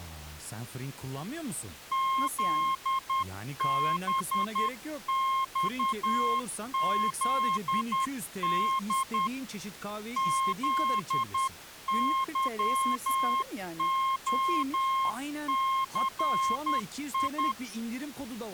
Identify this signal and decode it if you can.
Morse code, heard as a keyed tone, hand-sent with a paddle, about 10 wpm, 1070 Hz, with speech in Turkish. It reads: ZBXZD ZYOCI